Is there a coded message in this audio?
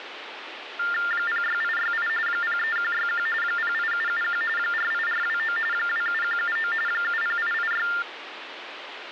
Yes: TTY/TDD text telephone tones (45.45 baud Baudot) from 0.8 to 8.0 s, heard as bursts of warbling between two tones, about 400 Hz shift, 1600 Hz centre, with phone line noise. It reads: 06868 03161 08771 48429 27179 70886